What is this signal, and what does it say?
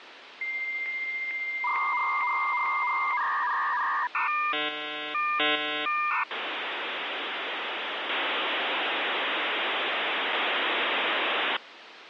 Dial-up modem handshake (V.34 or later), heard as a whistle, warbles, then hiss, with phone line noise.